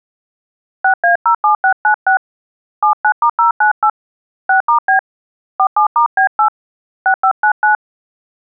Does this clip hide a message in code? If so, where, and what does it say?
Yes: DTMF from 0.8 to 7.8 s, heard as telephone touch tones, dialled by hand, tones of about 100 ms. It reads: 6A07696 79*098 6*B 47*B8 6599